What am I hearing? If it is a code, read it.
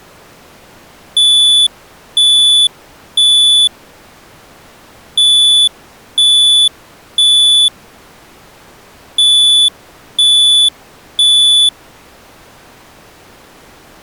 Alarm pattern, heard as an alarm's beeps, played three times, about 3450 Hz. Temporal three. Smoke or fire, evacuate.